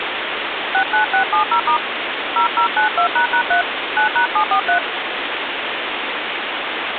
DTMF, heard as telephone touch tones, dialled by hand, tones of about 100 ms, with phone line noise. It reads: 69670* 0092##3 9#743